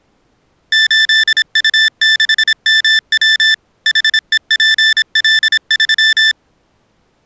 Morse code, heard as electronic beeps, machine-sent, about 26 wpm, 1750 Hz. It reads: 8U6MW HEPL3